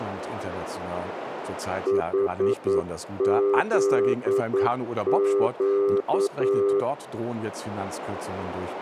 Morse code, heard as a keyed tone, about 9 wpm, 400 Hz, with speech in German. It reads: HZQ